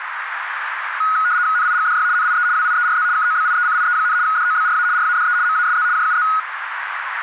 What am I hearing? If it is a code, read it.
RTTY (75 baud, 170 Hz shift), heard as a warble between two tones, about 1360 Hz centre, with radio static and a narrow filter. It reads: NIGDY NIE WIERZ KOBIECIE, DOBRA RADE MASZ JUZ